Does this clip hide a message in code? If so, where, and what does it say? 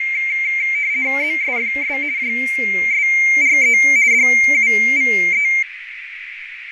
Yes: RTTY (50 baud, 170 Hz shift) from 0.0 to 5.6 s, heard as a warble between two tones, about 2200 Hz centre, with radio static, fading, a narrow filter and speech in Assamese. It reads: ZSFS JSRE DUVE